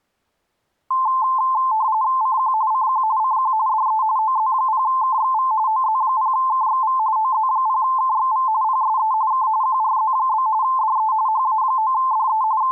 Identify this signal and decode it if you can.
RTTY (45.45 baud, 170 Hz shift), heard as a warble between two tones, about 960 Hz centre. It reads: CQ CQ CQ DE OZ0KXV OZ0KXV OZ0KXV PSE K QRZ? DE HA9DE …